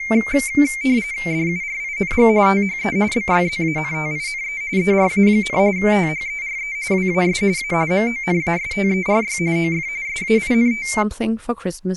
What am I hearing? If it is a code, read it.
RTTY (45.45 baud, 170 Hz shift), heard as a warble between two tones, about 2200 Hz centre, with speech in English. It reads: DURING THE BYZANTINE ERA, THERE WAS A MONASTERY OF SAINT